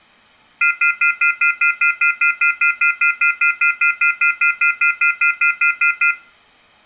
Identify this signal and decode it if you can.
Telephone call progress tone (North American plan), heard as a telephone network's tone, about 1400, 2050, 2450, 2600 Hz, 0.1 s on and 0.1 s off, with room echo. Off-hook warning tone.